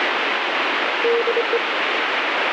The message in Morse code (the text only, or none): DE